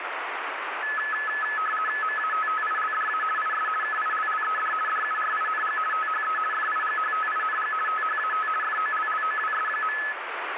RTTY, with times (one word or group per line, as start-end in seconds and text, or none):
2.0-3.2 MATTILDA
3.4-3.7 IS
3.8-4.7 KILLED
4.9-5.8 DURING
5.9-6.4 THE
6.5-7.7 FIGHTING
7.9-8.5 THAT
8.6-10.0 FOLLOWS.